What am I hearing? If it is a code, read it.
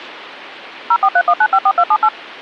DTMF, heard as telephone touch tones, dialled by machine, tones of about 60 ms. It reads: 0431954278